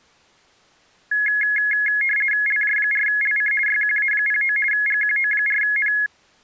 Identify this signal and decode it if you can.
RTTY (50 baud, 450 Hz shift), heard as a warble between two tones, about 1900 Hz centre. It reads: LJ4LC YQA09 GQO4N